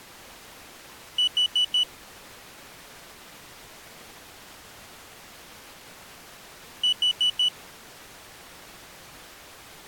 Alarm pattern, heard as an alarm's beeps, played twice, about 2950 Hz. Temporal four. Carbon monoxide.